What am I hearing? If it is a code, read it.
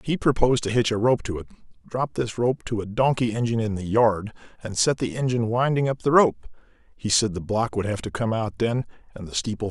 Speech in English. There is no code.